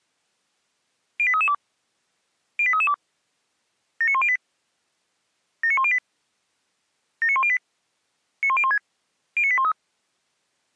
Five-tone selective call (ZVEI), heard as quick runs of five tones, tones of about 70 ms. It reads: 08332 08332 79108 79108 79108 91016 09813